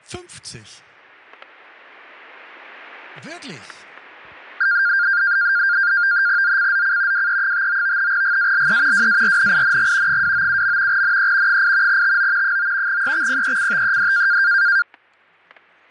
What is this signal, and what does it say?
NAVTEX (SITOR-B), 100 baud, 170 Hz shift, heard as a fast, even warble, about 1500 Hz centre, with static crashes. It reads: ZCZC WE59 GALE WARNING 297. NE 8 TO 9 EXPECTED